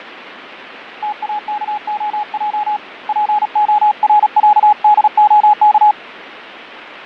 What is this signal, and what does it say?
Morse code (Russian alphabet), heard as a keyed tone, hand-sent with a paddle, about 36 wpm, 840 Hz, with radio static and fading. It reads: ТАКОЙ ПОРЯДОК